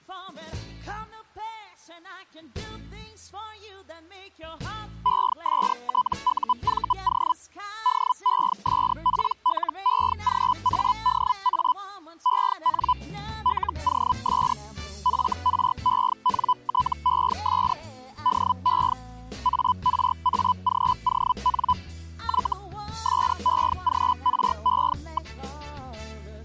Hellschreiber (Feld-Hell, 122.5 baud), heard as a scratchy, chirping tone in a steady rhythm, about 1000 Hz. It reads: ESTUVO DESPLEGADA EN LOS FRENTES DE ARAGON Y SEGRE.